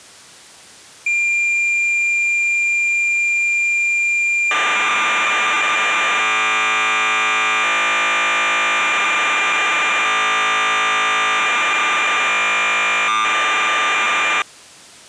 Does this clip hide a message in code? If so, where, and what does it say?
Yes: cassette data (Kansas City type), 1200 baud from 1.1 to 14.4 s, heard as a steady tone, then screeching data.